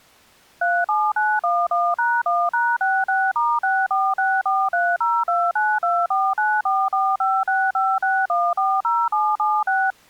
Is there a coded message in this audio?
Yes: DTMF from 0.6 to 9.9 s, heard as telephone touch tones, dialled by machine, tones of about 230 ms. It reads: 37911#1#66*64643029249445656140776